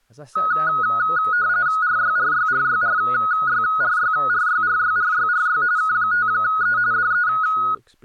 RTTY (45.45 baud, 170 Hz shift), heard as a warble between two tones, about 1360 Hz centre, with speech in English. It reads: RYRYRYRYRYRYRYRYRY K5E DE